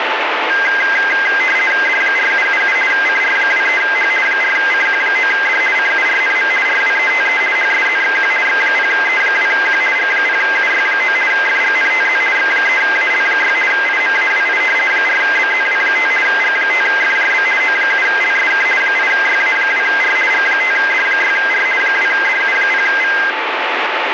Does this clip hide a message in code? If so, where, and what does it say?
Yes: RTTY (50 baud, 450 Hz shift) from 0.5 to 23.3 s, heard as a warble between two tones, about 1850 Hz centre, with radio static. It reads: D4777 CR23H 4CQ9D CURNM RWETE HSZXQ X0E2Q G0UY9 FGNTZ X3AL6 IMAWI 4BZW5 G5FJB O7LSK 8YA2R G5D6R 2DU0V